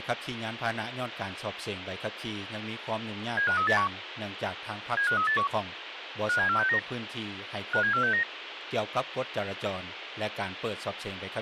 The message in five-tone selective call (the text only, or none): 75381 75381 57469 57469